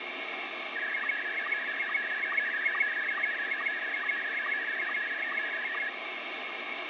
SSTV (slow-scan television), Scottie S1, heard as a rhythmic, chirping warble, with heavy radio static.